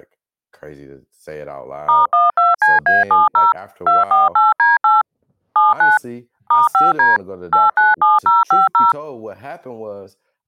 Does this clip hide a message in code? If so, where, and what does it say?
Yes: DTMF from 1.9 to 8.9 s, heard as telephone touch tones, dialled by machine, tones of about 170 ms, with speech in English. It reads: *12CA70 248D8 79 *5D 897050